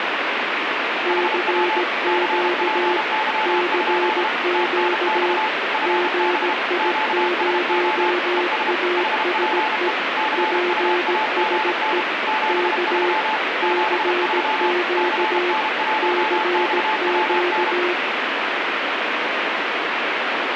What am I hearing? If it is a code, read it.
Morse code, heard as two keyed tones, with heavy radio static. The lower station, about 17 wpm, 360 Hz: CQ CQ GI0ASE PSE K CQ CQ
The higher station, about 32 wpm, 870 Hz: HW CPY? TNX FB QSO ES HPE CUAGN 73 73 CN1XWN